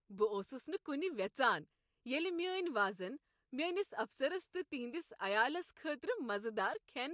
Speech in Kashmiri. There is no code.